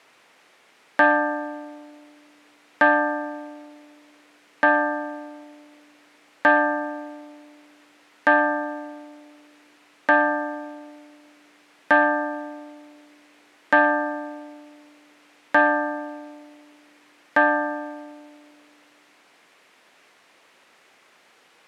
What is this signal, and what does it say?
Clock strike, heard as a bell. 10. Ten o'clock.